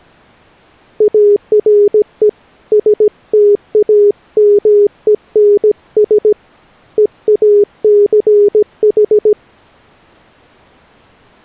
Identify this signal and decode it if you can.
Morse code, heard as a keyed tone, hand-sent with a paddle, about 17 wpm, 410 Hz. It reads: ARE STAMENS EACH